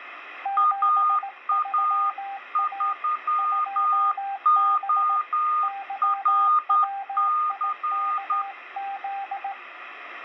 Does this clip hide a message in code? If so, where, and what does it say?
Yes: Morse code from 0.4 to 9.6 s, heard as two keyed tones, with radio static. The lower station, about 17 wpm, 790 Hz: 73A 2B YWIKZ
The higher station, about 10 wpm, 1220 Hz: AA3ORC